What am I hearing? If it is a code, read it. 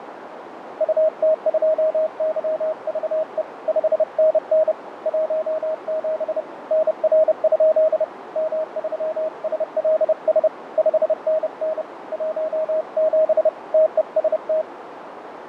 Morse code, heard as a keyed tone, hand-sent with a paddle, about 30 wpm, 630 Hz, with radio static, fading and a narrow filter. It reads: UT2YVE 5NN 17 NR? M3SLS 5NN 17 TEST